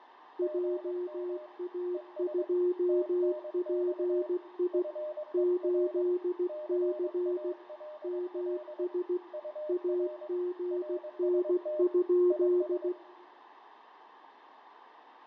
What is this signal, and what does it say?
Morse code, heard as two keyed tones, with fading and room echo. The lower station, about 16 wpm, 360 Hz: JA2PI 8C MS AGN?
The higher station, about 22 wpm, 610 Hz: GM ES TNX FER CALL UR RST IS